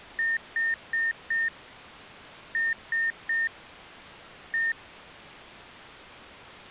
Beep code, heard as beeps from a small speaker, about 1800 Hz. 4-3-1. In Phoenix BIOS tables: memory failure above the first 64 KB.